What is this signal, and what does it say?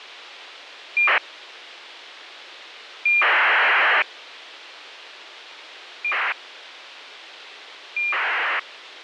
ACARS aircraft data, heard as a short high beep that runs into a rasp, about 2400 baud.